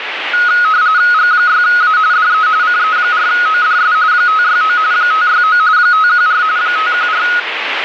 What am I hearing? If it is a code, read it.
RTTY (45.45 baud, 170 Hz shift), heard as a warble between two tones, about 1360 Hz centre, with radio static. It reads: G6A DE CE4ODS 569 569 514 514